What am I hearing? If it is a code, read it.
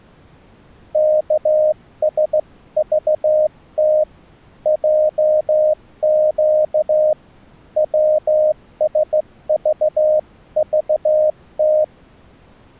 Morse code (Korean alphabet), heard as a keyed tone, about 15 wpm, 620 Hz. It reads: 여러 해 별러